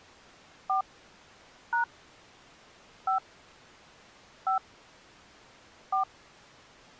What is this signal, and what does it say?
DTMF, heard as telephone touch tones, dialled by hand, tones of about 120 ms. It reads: 4 # 5 5 4